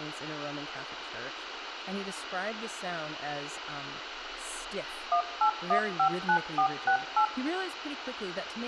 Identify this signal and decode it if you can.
DTMF, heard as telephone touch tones, dialled by machine, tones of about 90 ms, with radio hiss and room echo. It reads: 18159468